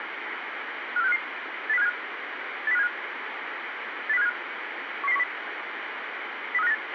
Five-tone selective call (EEA), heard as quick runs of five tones, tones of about 40 ms, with radio hiss and a squelch burst at the end. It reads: 54655 80575 80575 80575 11010 03598